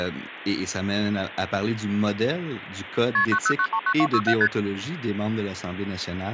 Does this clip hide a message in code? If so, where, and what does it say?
Yes: multi-frequency trunk signalling (R1, as on North American trunks) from 3.1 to 4.5 s, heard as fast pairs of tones, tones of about 70 ms, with phone line noise and speech in French. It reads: KP 90939267 ST